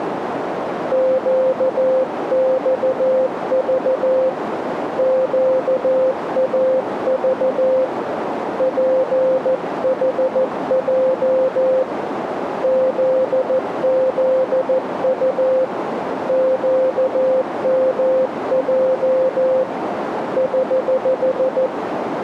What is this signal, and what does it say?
Morse code, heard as a keyed tone, hand-sent with a paddle, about 14 wpm, 520 Hz, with radio static and a narrow filter. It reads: QXV QAV PHJ ZZU QMJ <HH>